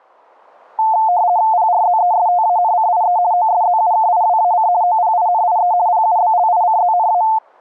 RTTY (50 baud, 170 Hz shift), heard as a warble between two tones, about 800 Hz centre. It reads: PRZESTANCIE OSZUKIWAC OPINIE PUBLICZNA